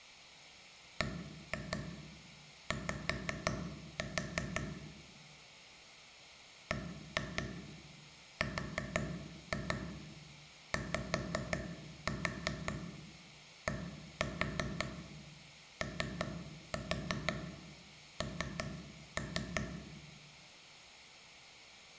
Tap code, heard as taps on a table, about 5 knocks a second, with room echo. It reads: BY BRYDON